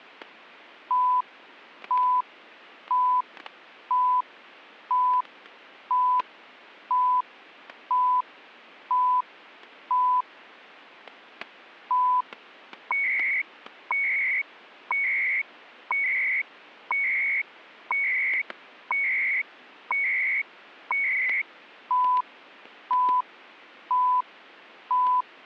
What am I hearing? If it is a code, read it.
Radio time signal (CHU, Canada), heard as beeps and data bursts, one a second, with static crashes.